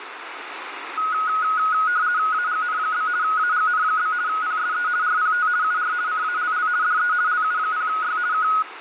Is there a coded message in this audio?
Yes: RTTY (50 baud, 170 Hz shift) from 1.0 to 8.6 s, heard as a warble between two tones, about 1360 Hz centre, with radio static. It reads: AGN? AGN? PSE RPT UR CALL DE LU0Y K